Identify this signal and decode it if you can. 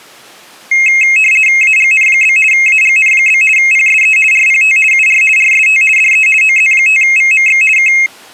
RTTY (50 baud, 450 Hz shift), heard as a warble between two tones, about 2350 Hz centre. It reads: AGN? AGN? PSE RPT UR RST DE OZ5VMX K